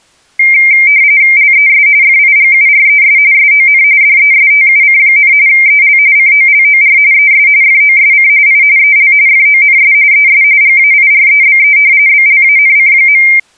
RTTY (45.45 baud, 170 Hz shift), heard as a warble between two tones, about 2200 Hz centre. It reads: LES FIGURES SON DESTUC, EL COLOR ES FOSC I EL FONS ES GAIREBE BLANC.